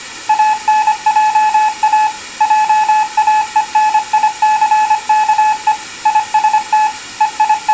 Morse code, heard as a keyed tone, machine-sent, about 25 wpm, 860 Hz. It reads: ANJA JAENICKE IST …